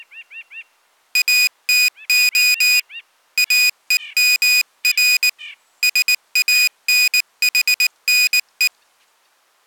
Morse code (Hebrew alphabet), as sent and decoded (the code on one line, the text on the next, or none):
.- - --- / .- . -- .-. / ... .- -. .... -. .
אתה אומר שאנחנו